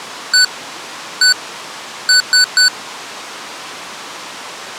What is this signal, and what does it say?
Beep code, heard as beeps from a small speaker, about 1500 Hz. 1-1-3. In Phoenix BIOS tables: CMOS read or write failure.